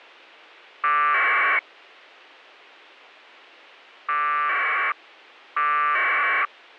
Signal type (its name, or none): packet radio (AX.25, as in APRS)